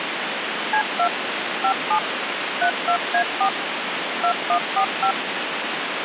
DTMF, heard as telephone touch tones, dialled by machine, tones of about 90 ms, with phone line noise. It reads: C2 57 32A4 2145